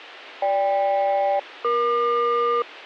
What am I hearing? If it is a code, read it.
Aircraft SELCAL, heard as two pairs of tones. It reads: GK-EQ